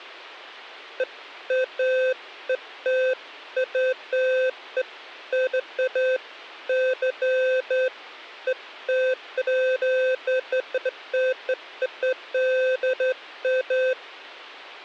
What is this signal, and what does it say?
Beeps of irregular length. There is no code.